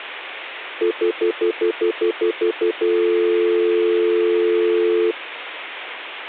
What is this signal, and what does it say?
Telephone call progress tone (North American plan), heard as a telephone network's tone, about 350, 440 Hz, 0.1 s on and 0.1 s off. Stutter dial tone.